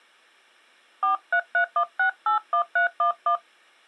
DTMF, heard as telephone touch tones, dialled by hand, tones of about 100 ms. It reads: 4331681311